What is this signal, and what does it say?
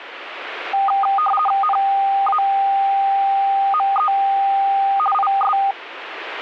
RTTY (50 baud, 450 Hz shift), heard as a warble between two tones, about 1010 Hz centre. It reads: NAME IS